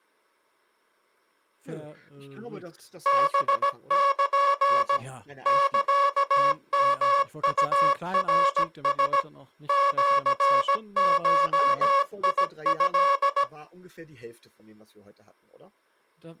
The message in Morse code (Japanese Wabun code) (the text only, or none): ハル サヨウナラ シゴト